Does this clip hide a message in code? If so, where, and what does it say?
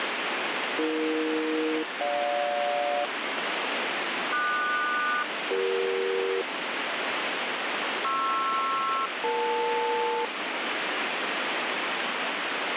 Yes: aircraft SELCAL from 0.8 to 10.3 s, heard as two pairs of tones, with radio static. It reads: AE-GJ QS-CE PR-EL